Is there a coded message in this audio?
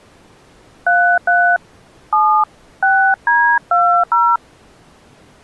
Yes: DTMF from 0.9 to 4.4 s, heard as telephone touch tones, dialled by hand, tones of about 290 ms. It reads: 33 7 6D20